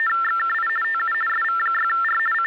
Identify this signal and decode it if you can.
RTTY (50 baud, 450 Hz shift), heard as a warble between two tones, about 1600 Hz centre. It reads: … TU SV6R …